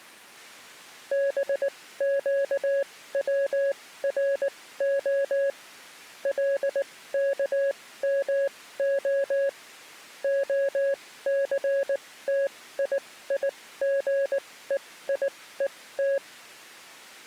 Morse code (Hebrew alphabet), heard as a keyed tone, machine-sent, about 19 wpm, spaced as for 15 wpm, 550 Hz. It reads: בקצרה לכמה הסתייגויות